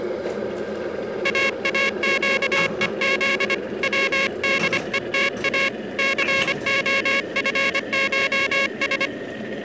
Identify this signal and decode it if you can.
Morse code (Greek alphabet), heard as a buzzer, hand-sent with a paddle, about 25 wpm, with kitchen noise. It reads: ΑΑΨΕΖ ΩΔΕΤΑ ΘΟΦΧΣ